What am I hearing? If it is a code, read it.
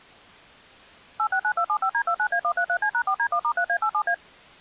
DTMF, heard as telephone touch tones, dialled by machine, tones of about 80 ms. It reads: 869275D29A133C#4D1*3A87A